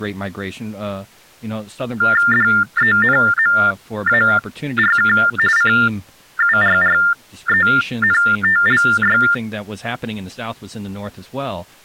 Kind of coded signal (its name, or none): TTY/TDD text telephone tones